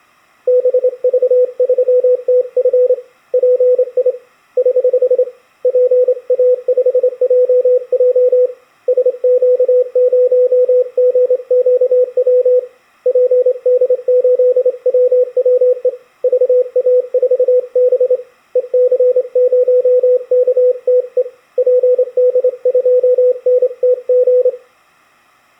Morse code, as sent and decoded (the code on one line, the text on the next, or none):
-... ...- ...-- - ..-. / .--. .. / ........ / .--. .- ..... .--- .--- / ... --.- ----- --. --.- .-- / .--. -.. ---.. .-- .-- . / ...- .- ....- -... / . -.-. ----- -.- - . / .--. -.. ..--- -. - --.
BV3TF PI <HH> PA5JJ SQ0GQW PD8WWE VA4B EC0KTE PD2NTG